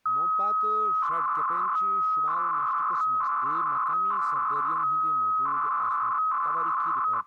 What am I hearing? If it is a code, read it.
300-baud modem data (Bell 103 tones), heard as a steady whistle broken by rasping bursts, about 300 baud, 200 Hz shift, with speech in Kashmiri.